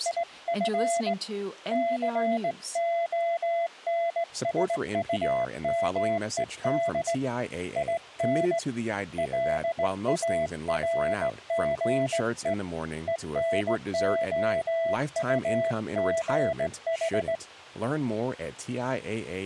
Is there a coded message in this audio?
Yes: Morse code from 0.0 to 17.4 s, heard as a keyed tone, hand-sent with a straight key, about 18 wpm, 670 Hz, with speech in English. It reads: IF CONSUMED IN LARGE ENOUGH